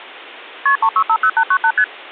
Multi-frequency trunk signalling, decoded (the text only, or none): KP 3650898 ST